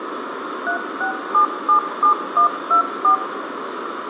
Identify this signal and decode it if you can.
DTMF, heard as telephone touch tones, dialled by machine, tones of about 100 ms, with phone line noise and room echo. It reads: 36777124